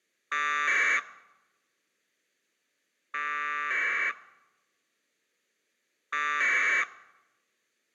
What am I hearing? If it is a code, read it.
Packet radio (AX.25, as in APRS), 1200 baud, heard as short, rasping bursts.